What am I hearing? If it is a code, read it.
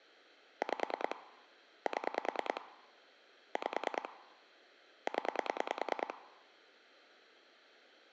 Pulse dialling, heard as clicks on a phone line, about 9 pulses a second. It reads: 5 7 5 0